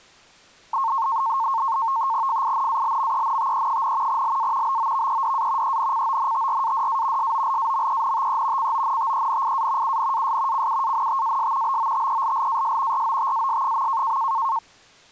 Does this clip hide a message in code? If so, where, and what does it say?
Yes: NAVTEX (SITOR-B), 100 baud, 170 Hz shift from 0.7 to 14.6 s, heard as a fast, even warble, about 990 Hz centre. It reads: FINALMENTE, LA BOVEDA ENCONTRADA SOLAMENTE CONTENIA UNAS CUANTAS BOTELLAS ROTAS.